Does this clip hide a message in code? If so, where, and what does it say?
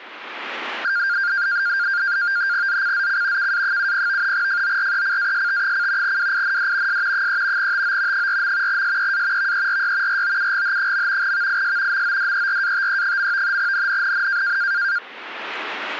Yes: NAVTEX (SITOR-B), 100 baud, 170 Hz shift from 0.8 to 15.0 s, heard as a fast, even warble, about 1500 Hz centre. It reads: ZCZC KA70 FORECAST: WIND S 3 TO 4. SEA VERY ROUGH. VIS MODERATE. NNNN